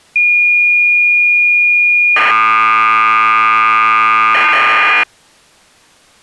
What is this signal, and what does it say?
Cassette data (Kansas City type), 1200 baud, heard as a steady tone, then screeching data.